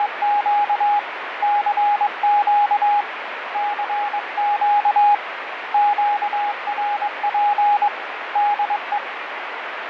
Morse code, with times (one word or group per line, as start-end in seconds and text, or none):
0.0-1.0 …
1.4-3.0 CQ
3.5-5.1 CQ
5.7-7.9 QRP
8.4-9.0 DE